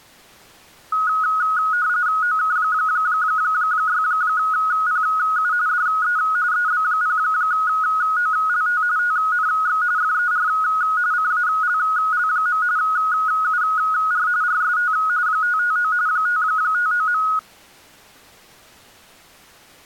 RTTY (45.45 baud, 170 Hz shift), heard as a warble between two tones, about 1360 Hz centre. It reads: OK6PU DE EB0OLT TNX FER CALL. UR RST 559 559.